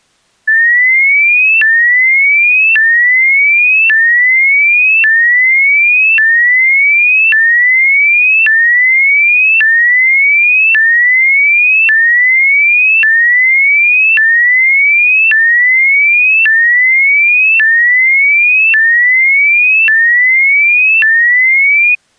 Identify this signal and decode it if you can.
A tone that sweeps in pitch again and again. There is no code.